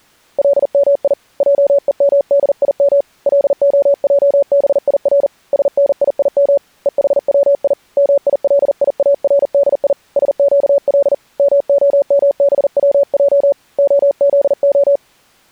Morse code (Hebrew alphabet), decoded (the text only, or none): למי עומדים להעביר שניים וחצי מיליארדי שקל מהמבצע הזה